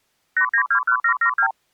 Multi-frequency trunk signalling (R2, with the far end's replies), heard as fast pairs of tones, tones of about 80 ms. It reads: 8921772